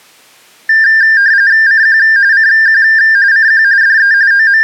RTTY (45.45 baud, 170 Hz shift), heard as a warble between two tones, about 1700 Hz centre. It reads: CQ CQ CQ DE …